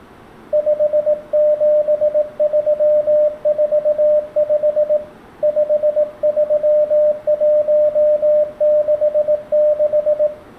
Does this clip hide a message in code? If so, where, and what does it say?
Yes: Morse code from 0.5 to 10.3 s, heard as a keyed tone, hand-sent with a paddle, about 18 wpm, 600 Hz, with room echo. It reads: 57345 53166